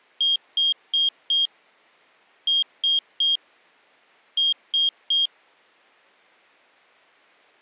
Beep code, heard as a piezo beeper, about 3250 Hz. 4-3-3. In Phoenix BIOS tables: timer channel 2 failure.